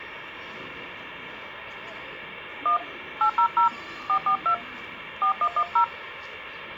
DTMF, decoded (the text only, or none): 1 800 442 4110